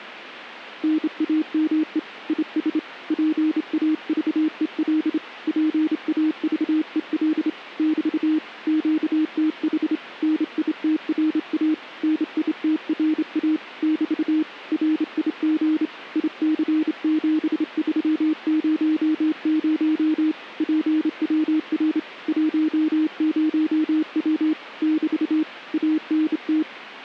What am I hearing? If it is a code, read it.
Morse code, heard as a keyed tone, hand-sent with a straight key, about 28 wpm, 310 Hz. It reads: NAME IS PAVEL PAVEL <BT> QTH NITRA NITRA <BT> RIG IC7300 PWR 10W <BT> ANT